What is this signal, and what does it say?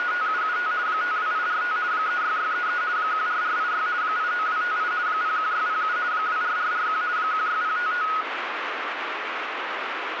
RTTY (50 baud, 170 Hz shift), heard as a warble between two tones, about 1360 Hz centre, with radio static. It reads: … 52845 36633 14486 89258 01607 24441 16055